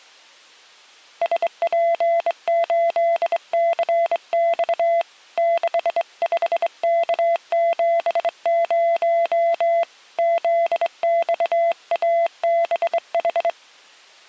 Morse code, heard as a keyed tone, hand-sent with a straight key, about 23 wpm, 680 Hz. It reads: SP8CX 65K70 ZXABH